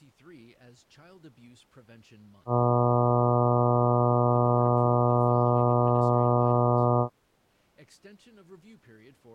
Ship horn signal, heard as a ship's horn, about 120 Hz, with speech in English. 1 long. At sea: a vessel nearing a blind bend, or under power and making way in fog.